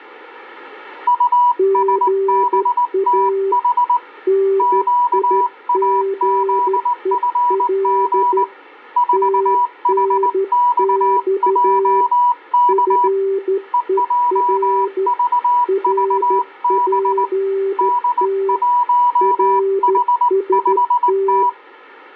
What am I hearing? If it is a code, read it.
Morse code, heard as two keyed tones. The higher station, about 19 wpm, 980 Hz: USBTH QAZFG 4HXJK EJVVB D1H5T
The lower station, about 13 wpm, 390 Hz: GA NIGEL TNX FER RPT RST